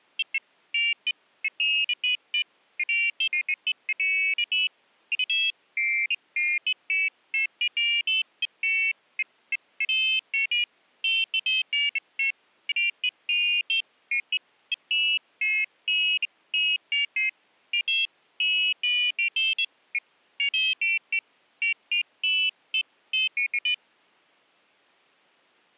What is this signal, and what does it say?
Pairs of high tones at irregular times. There is no code.